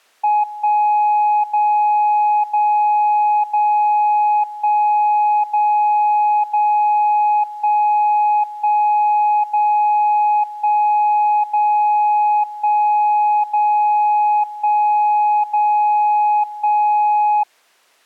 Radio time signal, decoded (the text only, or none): 1 0 0 0 1 0 0 1 1 0 1 0 1 0 1 0 1